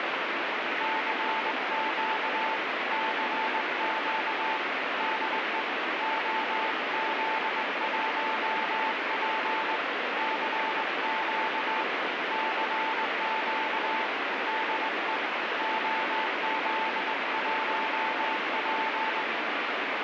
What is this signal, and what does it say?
Morse code, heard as a keyed tone, hand-sent with a straight key, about 20 wpm, 880 Hz, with heavy radio static. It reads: CQ CQ DE OZ1P CQ CQ DE OZ1P